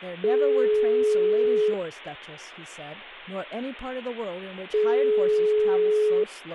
Telephone call progress tone (single-tone plan, as in most of Europe), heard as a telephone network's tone, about 420 Hz, 1.5 s on and 3 s off, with speech in English. Ringback tone.